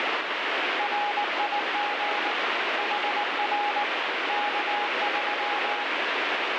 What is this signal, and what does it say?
Morse code, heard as a keyed tone, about 19 wpm, 830 Hz, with heavy radio static. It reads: RIG HR K3